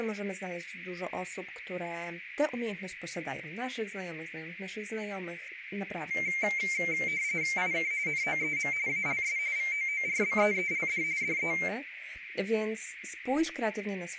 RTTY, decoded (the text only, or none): IK NOEM ALS VOORBEELD DE